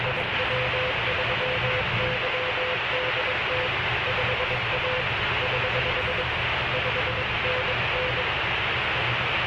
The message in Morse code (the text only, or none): IW3YDT 5A <HH> 5NN